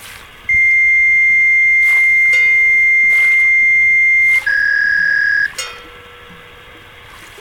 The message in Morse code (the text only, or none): none